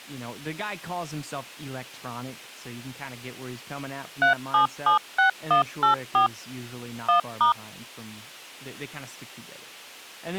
DTMF, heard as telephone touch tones, dialled by machine, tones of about 120 ms, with speech in English. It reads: 3776184 1*